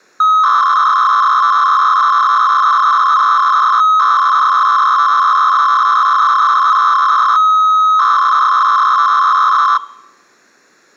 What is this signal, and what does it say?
300-baud modem data (Bell 103 tones), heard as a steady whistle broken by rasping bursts, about 300 baud, 200 Hz shift.